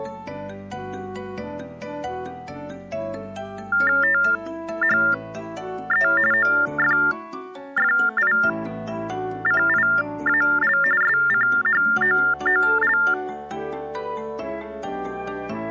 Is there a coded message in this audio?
Yes: TTY/TDD text telephone tones (45.45 baud Baudot) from 3.7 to 13.1 s, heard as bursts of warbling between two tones, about 400 Hz shift, 1600 Hz centre. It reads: THE OFFICIAL SCHOOL